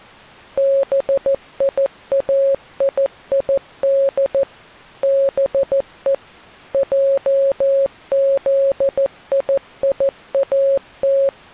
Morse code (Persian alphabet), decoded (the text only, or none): بیایید به جزییات